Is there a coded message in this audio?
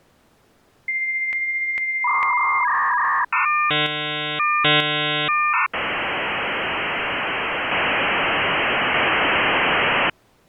Yes: dial-up modem handshake (V.34 or later) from 0.9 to 10.1 s, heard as a whistle, warbles, then hiss.